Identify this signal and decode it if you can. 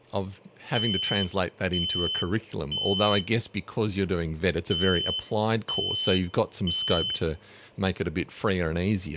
Alarm pattern, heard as an alarm's beeps, played twice, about 3050 Hz, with speech in English. Temporal three. Smoke or fire, evacuate.